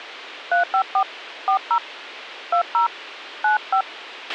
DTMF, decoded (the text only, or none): 354 40 20 95